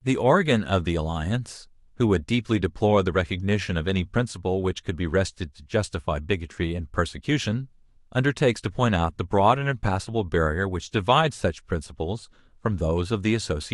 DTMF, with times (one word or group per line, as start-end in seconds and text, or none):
none